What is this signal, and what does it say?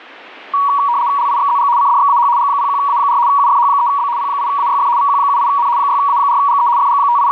RTTY (75 baud, 170 Hz shift), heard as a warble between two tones, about 1040 Hz centre. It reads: LIXZG CDXAH G01A4 UFH3B P8AYF VQ78N 6A4GE …